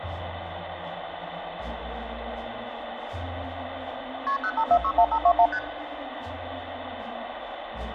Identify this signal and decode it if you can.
Multi-frequency trunk signalling (R1, as on North American trunks), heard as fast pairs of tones, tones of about 70 ms, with phone line noise. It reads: KP 05461521 ST